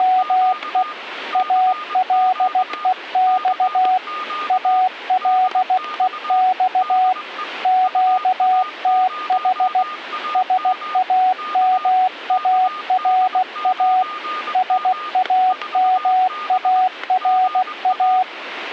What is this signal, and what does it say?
Morse code, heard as a keyed tone, machine-sent, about 16 wpm, 740 Hz, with static crashes and a weaker station near 1220 Hz. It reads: … ALEX ALEX QTH SAMARA SAMARA